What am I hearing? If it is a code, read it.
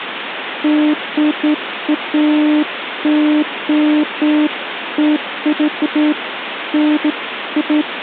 Beeps of irregular length, with phone line noise. There is no code.